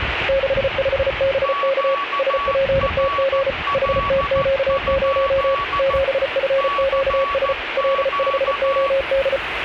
Morse code, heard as two keyed tones, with radio static and the noise of a residential street. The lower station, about 34 wpm, 540 Hz: 65BK SPTG HTQ0 7FQS L5OD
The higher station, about 14 wpm, 1130 Hz: QRL? CQ